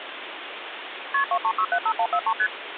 Multi-frequency trunk signalling (R1, as on North American trunks), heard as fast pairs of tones, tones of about 70 ms, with phone line noise. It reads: KP 23675143 ST